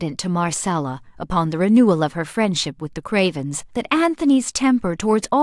Speech in English. There is no code.